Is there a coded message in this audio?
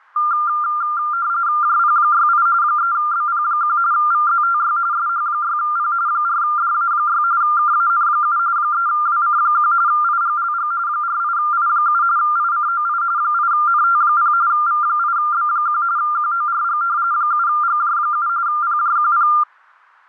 Yes: RTTY (45.45 baud, 170 Hz shift) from 0.2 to 19.4 s, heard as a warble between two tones, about 1290 Hz centre. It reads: JP68 3BP1 VZTY SH6P 4DA6 KAN7 3WC1 IGLG 48I7 ICOI 8NT0 V8B1 QORG 7GJ7 PJQP